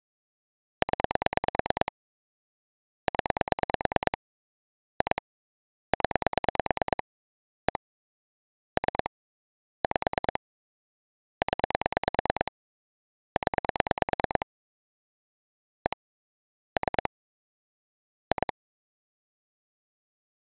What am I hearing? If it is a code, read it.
Pulse dialling, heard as clicks on a phone line, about 9 pulses a second. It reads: 0 0 2 0 1 3 5 0 0 1 3 2